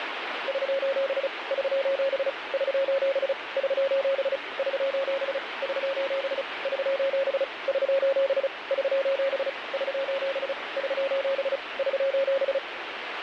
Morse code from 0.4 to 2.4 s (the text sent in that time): <SOS> <SOS>